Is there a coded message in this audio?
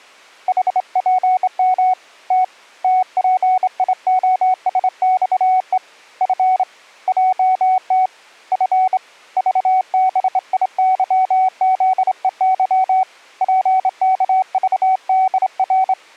Yes: Morse code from 0.4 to 16.0 s, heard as a keyed tone, hand-sent with a straight key, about 26 wpm, 750 Hz. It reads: HPM T TPIOSXE F JT F VBIYZEY PKVDR